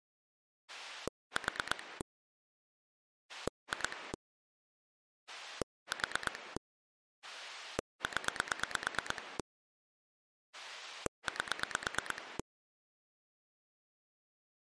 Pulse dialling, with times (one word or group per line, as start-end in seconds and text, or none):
0.7-2.0 4
3.3-4.1 2
5.3-6.6 4
7.2-9.4 0
10.5-12.4 8